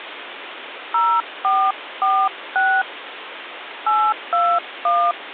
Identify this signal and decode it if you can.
DTMF, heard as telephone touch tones, dialled by hand, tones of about 260 ms, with phone line noise. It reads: 0446 821